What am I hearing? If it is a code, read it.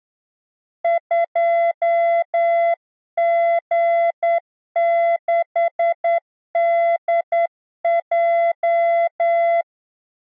Morse code, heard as a keyed tone, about 9 wpm, 680 Hz. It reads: 2G6DJ